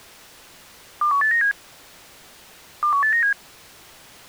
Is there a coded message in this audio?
Yes: five-tone selective call (CCIR) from 1.0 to 3.3 s, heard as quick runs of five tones, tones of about 100 ms. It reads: 21897 21897